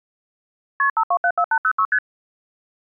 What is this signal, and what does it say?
Multi-frequency trunk signalling (R1, as on North American trunks), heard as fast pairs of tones, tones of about 70 ms. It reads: KP 5274806 ST